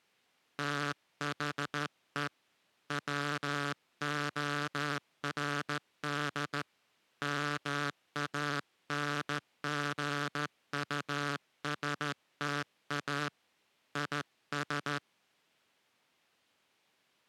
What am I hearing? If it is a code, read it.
Morse code, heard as a buzzer, hand-sent with a straight key, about 14 wpm. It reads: THE WORD MANGUSTA IS